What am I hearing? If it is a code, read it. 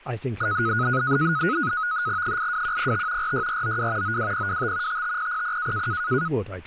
NAVTEX (SITOR-B), 100 baud, 170 Hz shift, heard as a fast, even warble, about 1360 Hz centre, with speech in English. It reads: 82105 46492 92025 55000